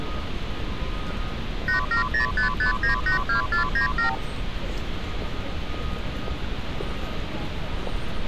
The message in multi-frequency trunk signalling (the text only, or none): 87055982497